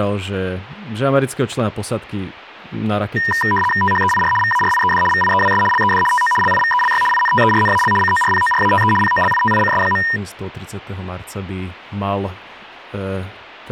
RTTY (75 baud, 850 Hz shift), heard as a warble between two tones, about 1410 Hz centre, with radio static and speech in Slovak. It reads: THEIR VARIED VIEWS LED TO LIVELY INTERNAL CORPORATE POLITICS.